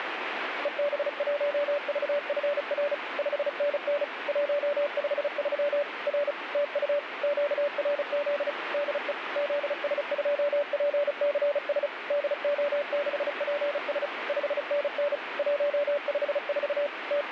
Morse code, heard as a keyed tone, machine-sent, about 35 wpm, 580 Hz, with radio static. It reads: EB1VFR 5NN 153 R TU QRZ DE ZS2PCS DO6PS 5NN 154 …